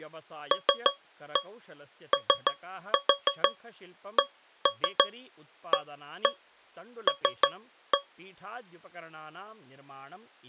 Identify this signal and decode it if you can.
Tap code, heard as taps on a metal pipe, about 6 knocks a second, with speech in Sanskrit. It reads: LOCAL